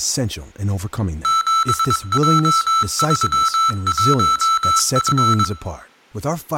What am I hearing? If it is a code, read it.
Morse code, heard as electronic beeps, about 22 wpm, 1320 Hz, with room echo and speech in English. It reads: 7J31F